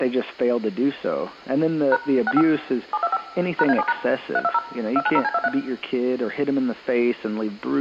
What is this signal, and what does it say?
DTMF, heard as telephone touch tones, dialled by machine, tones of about 40 ms, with room echo. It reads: # 65 725 #A7# 320 290C23